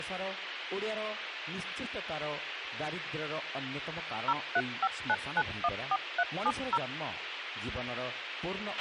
DTMF, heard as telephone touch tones, dialled by machine, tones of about 50 ms, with radio hiss and a squelch burst at the end. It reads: 0359914370